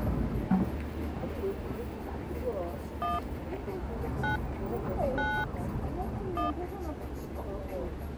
DTMF, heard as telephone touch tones, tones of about 180 ms, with street noise. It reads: 1 9 9 1